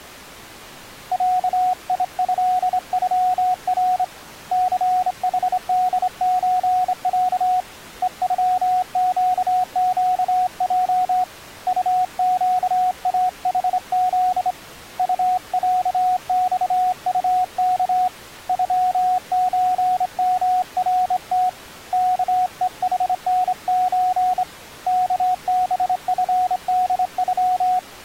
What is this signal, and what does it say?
Morse code (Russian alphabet), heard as a keyed tone, hand-sent with a straight key, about 26 wpm, 730 Hz. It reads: ЯИЭЮР ЦХДЧЯ ЕЮЩЩЙ УЩАХЗ УЯЬУК ЮЧМРТ КЕХНЧ КБФДЮ